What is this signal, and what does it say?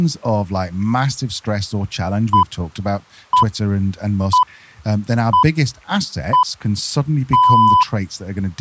Radio time signal (six pips, as the Greenwich Time Signal), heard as pips, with speech in English.